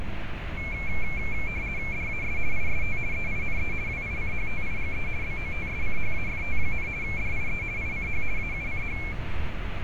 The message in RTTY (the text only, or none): DAS IST EINE WICHTIGE BOTSCHAFT, DIE ICH AUCH